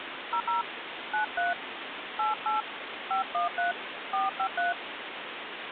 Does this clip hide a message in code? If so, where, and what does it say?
Yes: DTMF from 0.3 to 4.7 s, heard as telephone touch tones, dialled by hand, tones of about 130 ms, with phone line noise. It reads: 00 93 88 513 453